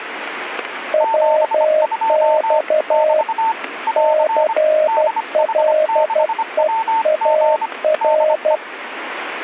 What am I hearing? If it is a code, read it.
Morse code, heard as two keyed tones, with radio static and static crashes. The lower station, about 12 wpm, 620 Hz: WX CLEAR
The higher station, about 25 wpm, 900 Hz: 72 <BT> <AR> DH6WG DE